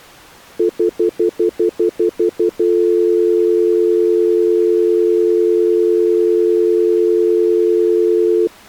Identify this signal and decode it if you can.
Telephone call progress tone (North American plan), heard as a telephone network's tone, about 350, 440 Hz, 0.1 s on and 0.1 s off. Stutter dial tone.